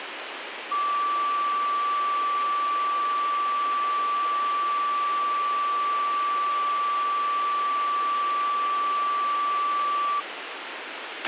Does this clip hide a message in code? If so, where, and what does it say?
No, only a steady tone, with radio hiss and a squelch burst at the end.